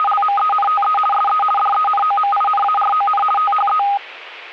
RTTY (50 baud, 450 Hz shift), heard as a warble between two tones, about 1030 Hz centre. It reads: … SE DENOMINARON THE